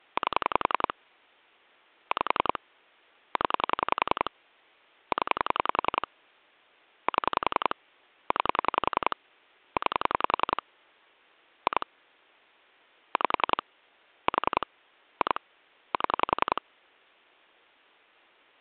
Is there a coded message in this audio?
Yes: pulse dialling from 0.2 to 16.6 s, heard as clicks on a phone line, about 10 pulses a second. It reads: 8 5 0 0 7 9 9 2 5 4 2 7